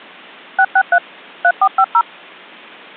DTMF, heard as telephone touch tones, dialled by machine, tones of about 60 ms. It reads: 663 3450